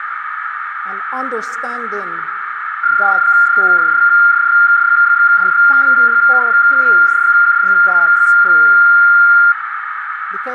PSK31 (31.25 baud), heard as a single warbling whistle, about 1400 Hz, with radio static and a narrow filter.